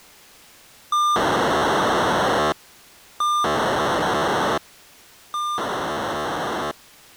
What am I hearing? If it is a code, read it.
POCSAG pager data (2400 baud), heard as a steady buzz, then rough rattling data.